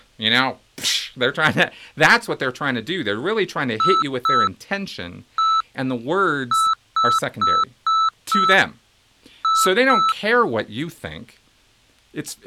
Beep code, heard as beeps, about 1320 Hz, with speech in English. 2-1-5-2.